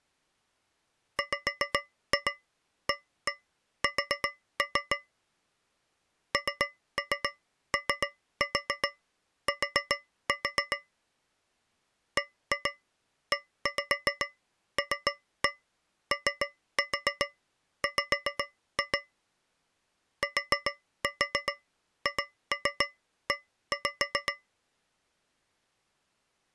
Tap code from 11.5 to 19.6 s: BELOW

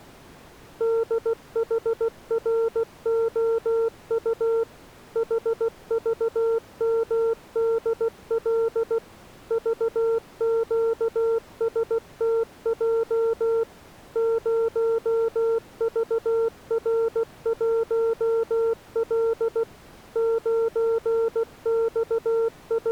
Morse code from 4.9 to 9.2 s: HVMDL

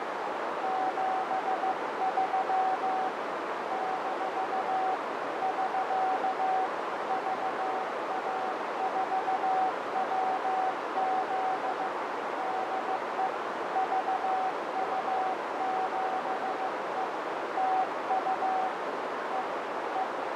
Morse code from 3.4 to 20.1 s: - <SK> VA4WZ DE VU7E TU E E

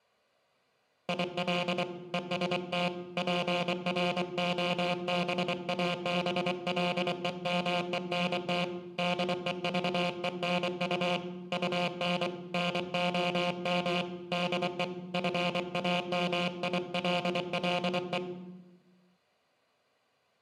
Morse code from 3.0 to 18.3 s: PROBABLEMENT DEVENU UN NOM DE FAMILLE

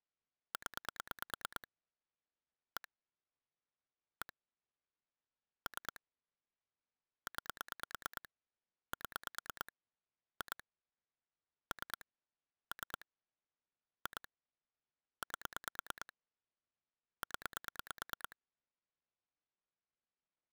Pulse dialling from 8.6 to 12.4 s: 7 2 3

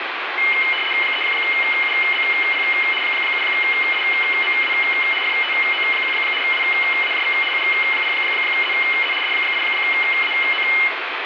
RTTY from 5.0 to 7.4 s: FTO1 WAJV

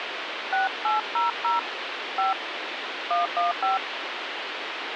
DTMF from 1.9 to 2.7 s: 5

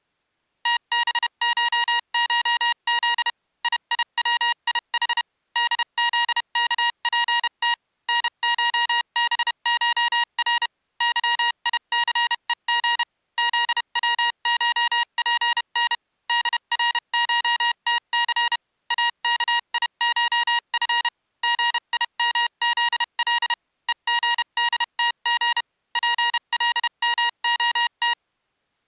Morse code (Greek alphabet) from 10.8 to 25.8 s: ΥΙΘΕΓ ΖΩΧΠΝ ΔΡΧΤΘ ΑΚΙΧΦ ΓΙΜΖΛ ΕΓΔΤΓ

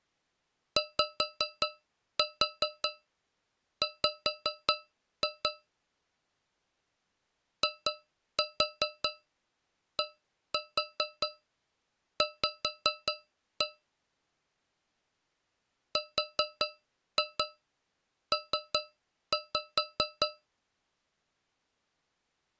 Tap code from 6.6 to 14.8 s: IDV

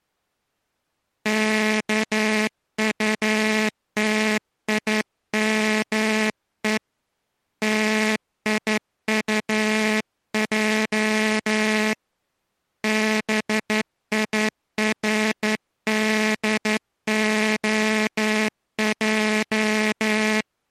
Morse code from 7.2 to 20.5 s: TIUJ BIRDOJ

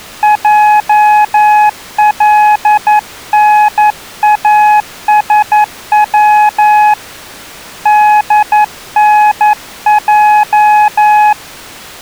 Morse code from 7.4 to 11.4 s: DNJ

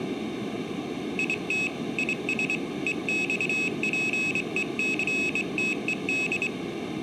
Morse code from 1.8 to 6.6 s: IS EXPECTED

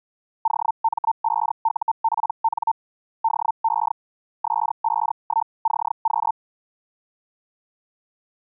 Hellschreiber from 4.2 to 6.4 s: S51CQ

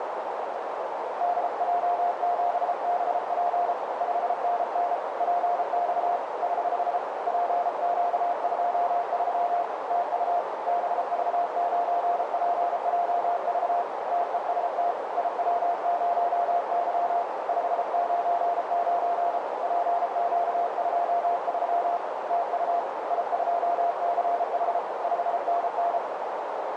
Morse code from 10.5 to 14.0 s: BV9PJV

